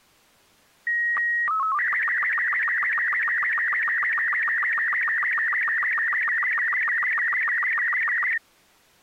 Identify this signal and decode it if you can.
SSTV (slow-scan television), Robot 36, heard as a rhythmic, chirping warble.